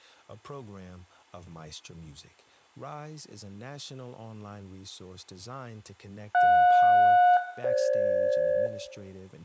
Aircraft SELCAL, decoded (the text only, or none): JS-FG